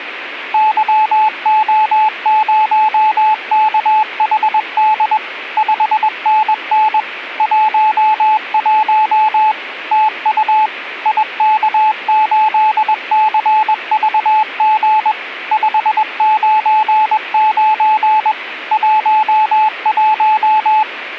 Morse code, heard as a keyed tone, machine-sent, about 21 wpm, 860 Hz. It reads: YO0KHD 5NN 11 TU IK8CVG 599 11